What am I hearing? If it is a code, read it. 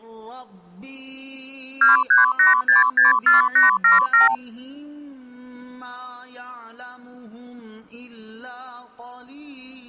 Multi-frequency trunk signalling (R2, with the far end's replies), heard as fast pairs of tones, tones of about 140 ms. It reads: 238664877